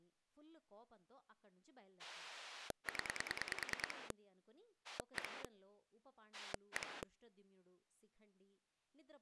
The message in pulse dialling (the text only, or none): 0 1 1